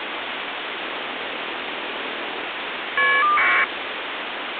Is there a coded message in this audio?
Yes: caller ID data burst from 0.8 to 3.6 s, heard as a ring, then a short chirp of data, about 1200 baud, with phone line noise.